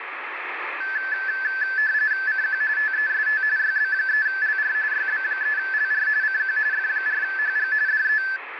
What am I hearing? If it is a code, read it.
RTTY (45.45 baud, 170 Hz shift), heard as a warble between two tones, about 1650 Hz centre, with radio static. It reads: CQ TEST YB3LR YB3LR CQ F4HG DE